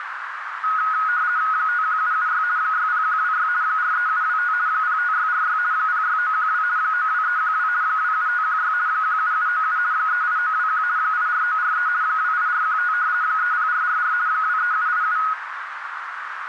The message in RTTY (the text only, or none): 51776 60126 43725 05646 06912 92312 27516 17797 38921 84943 28415 30444 23787